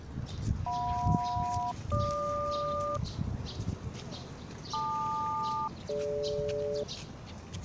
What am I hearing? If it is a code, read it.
Aircraft SELCAL, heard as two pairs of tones, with the noise of a park. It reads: JM-GQ LQ-DG